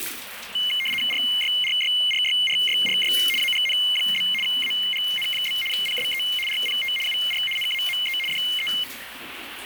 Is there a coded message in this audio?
Yes: RTTY (75 baud, 850 Hz shift) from 0.6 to 8.8 s, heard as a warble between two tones, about 2550 Hz centre, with radio static and the noise of a restroom. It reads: RYRYRYRYRY AGN? AGN? PSE RPT UR NAME DE